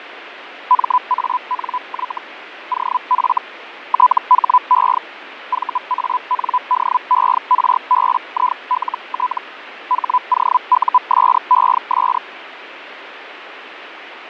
Hellschreiber (Feld-Hell, 122.5 baud), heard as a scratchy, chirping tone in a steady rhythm, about 1000 Hz, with radio static and fading. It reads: MANY OF THE VANDERBILT HOUSES